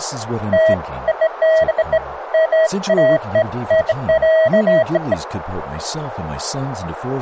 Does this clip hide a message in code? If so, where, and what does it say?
No, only beeps of irregular length, with speech in English.